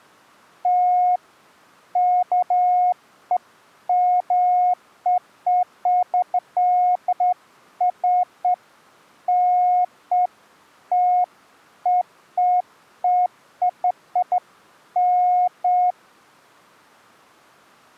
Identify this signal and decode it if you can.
Beeps of irregular length. There is no code.